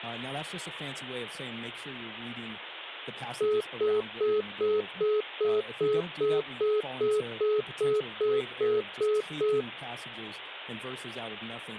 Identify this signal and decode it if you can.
Telephone call progress tone (single-tone plan, as in most of Europe), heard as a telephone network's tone, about 420 Hz, 0.2 s on and 0.2 s off. Congestion tone.